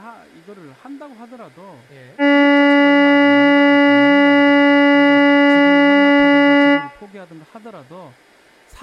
Ship horn signal, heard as a ship's horn, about 280 Hz, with room echo and speech in Korean. 1 long. At sea: a vessel nearing a blind bend, or under power and making way in fog.